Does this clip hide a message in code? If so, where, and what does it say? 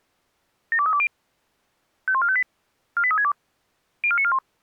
Yes: five-tone selective call (ZVEI) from 0.7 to 4.4 s, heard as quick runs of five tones, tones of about 70 ms. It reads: 72320 51458 48362 04941